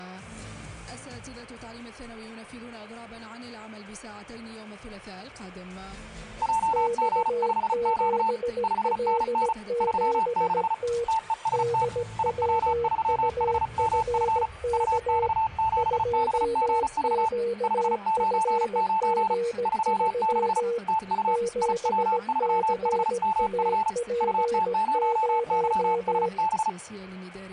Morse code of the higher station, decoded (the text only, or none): JG5Q 5NN 36 TEST IW3HMF UX7BGV 599 36 TU IW3HMF UT0YSB